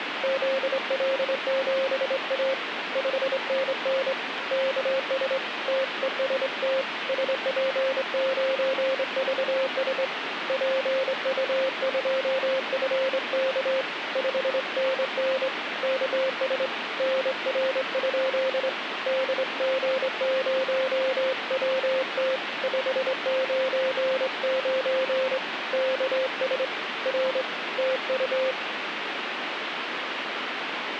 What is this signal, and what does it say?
Morse code, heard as a keyed tone, hand-sent with a straight key, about 24 wpm, 530 Hz, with radio static. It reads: ZL7A 5NN KS TEST SP9VS PU2FK 5NN KS NR? DG0WT 599 KS R TU